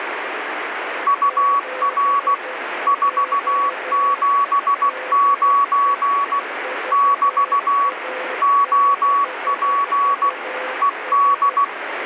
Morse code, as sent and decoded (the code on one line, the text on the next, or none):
..- .-. / ....- --... ----. / -...- / --- .--. / . -..
UR 479 <BT> OP ED